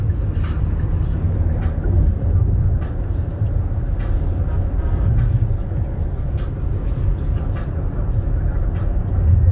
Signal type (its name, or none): none